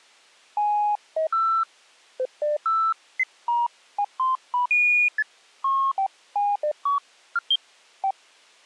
Electronic bleeps of random pitch and length. There is no code.